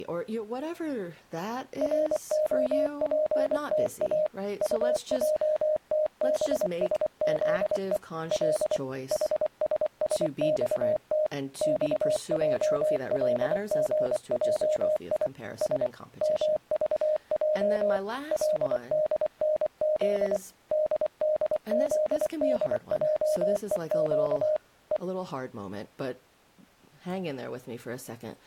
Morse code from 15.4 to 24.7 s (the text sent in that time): S MVJ LDNZ DDZDJEQ